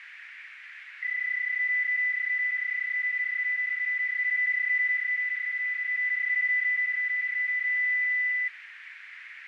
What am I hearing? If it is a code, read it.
PSK31 (31.25 baud), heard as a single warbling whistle, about 2000 Hz, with radio static and a narrow filter.